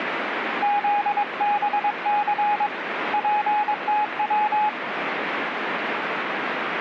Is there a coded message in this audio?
Yes: Morse code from 0.6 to 4.8 s, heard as a keyed tone, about 22 wpm, 830 Hz, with radio static. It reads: ZBC PTW